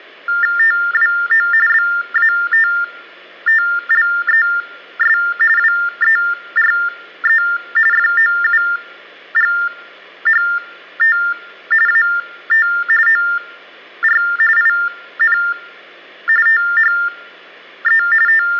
TTY/TDD text telephone tones (45.45 baud Baudot), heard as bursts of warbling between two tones, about 400 Hz shift, 1600 Hz centre. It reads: TWO BATTLES WERE FOUGHT AT OR IN THE …